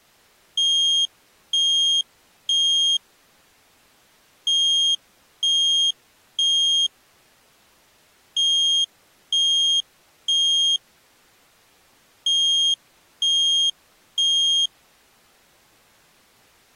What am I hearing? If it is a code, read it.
Alarm pattern, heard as an alarm's beeps, played four times, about 3250 Hz. Temporal three. Smoke or fire, evacuate.